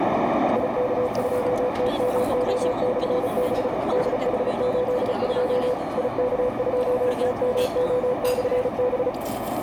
Morse code, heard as a keyed tone, machine-sent, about 35 wpm, 500 Hz, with radio static, a narrow filter and the noise of a restaurant. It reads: IK2TMO/B DH82 IK2TMO/B